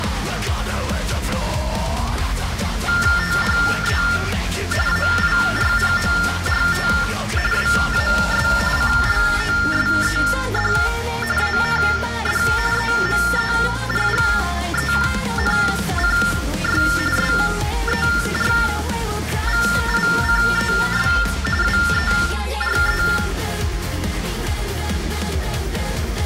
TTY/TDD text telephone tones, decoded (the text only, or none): THE AIRPORT WAS CLOSED AND EMERGENCY SERVICES WERE